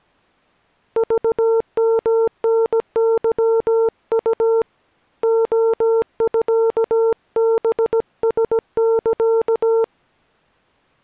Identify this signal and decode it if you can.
Morse code (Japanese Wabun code), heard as a keyed tone, hand-sent with a paddle, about 17 wpm, 450 Hz. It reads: クヨタケウ レミハラサ